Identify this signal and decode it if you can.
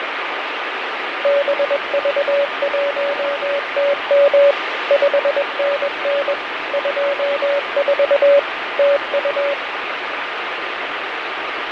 Morse code, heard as a keyed tone, machine-sent, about 21 wpm, 570 Hz, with radio static and fading. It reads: BV1TM 5NN 24 TU